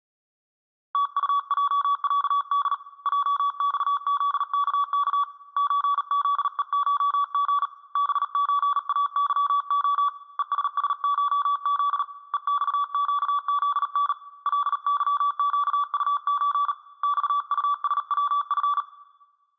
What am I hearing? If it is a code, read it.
Morse code (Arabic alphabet), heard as a keyed tone, hand-sent with a paddle, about 38 wpm, 1140 Hz, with room echo. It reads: تطجعد جصذكك زذءشغ بزاظخ ءسسشذ ءصقذن لظقطز صطسوف